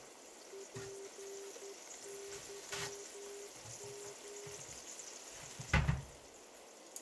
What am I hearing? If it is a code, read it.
Morse code, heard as a keyed tone, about 11 wpm, 400 Hz, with heavy radio static, a narrow filter and kitchen noise. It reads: PYM